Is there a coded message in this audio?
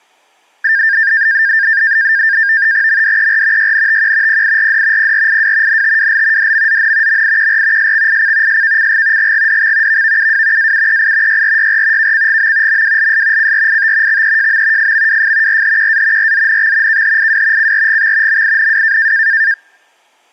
Yes: NAVTEX (SITOR-B), 100 baud, 170 Hz shift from 0.6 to 19.5 s, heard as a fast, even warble, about 1700 Hz centre. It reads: MDER YNTQ PIRD PRIW NTWL DMZN MIQR SXIC SKCG GGDX VVUW AUEI YRYR KCGM MWLS CRIT XEJM FMWF RHQA RZNX KHIW CRGX MINW